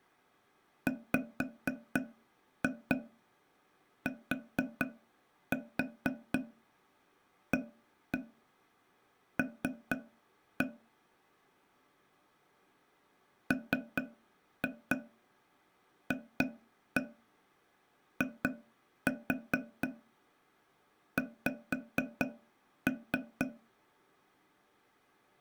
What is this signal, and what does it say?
Tap code, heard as taps on a table, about 4 knocks a second. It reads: WTAL MFIX